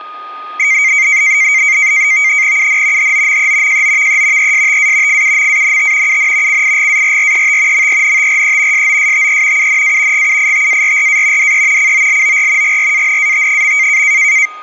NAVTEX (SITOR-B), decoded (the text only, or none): UN HOME JOVE ESTA FUMANT UN CIGARRET MENTRE SOSTE UNA GUITARRA DE COLOR GRANAT.